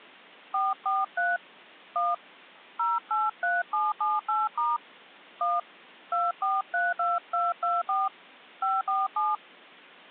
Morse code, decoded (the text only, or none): none